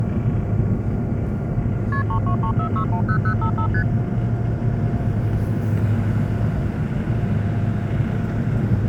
Multi-frequency trunk signalling (R1, as on North American trunks), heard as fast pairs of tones, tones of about 90 ms, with the noise inside a subway train. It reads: KP 3234610055 ST